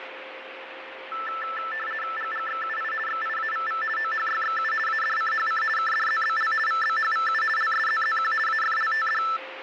RTTY (50 baud, 450 Hz shift), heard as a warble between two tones, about 1550 Hz centre, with radio static, fading and a steady whistle near 530 Hz. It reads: GGXUI XIAVV OHYXU ADCHC KDZBL VBHVU LSZZQ AFLTD